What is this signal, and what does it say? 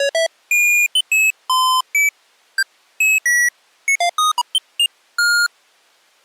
Electronic bleeps of random pitch and length. There is no code.